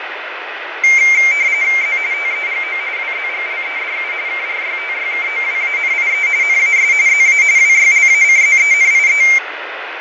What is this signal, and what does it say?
RTTY (45.45 baud, 170 Hz shift), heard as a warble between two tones, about 2200 Hz centre, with radio static and fading. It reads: Z TEGO WZGLEDU KRYTYKOWANIE NAS ZA WYLACZENIE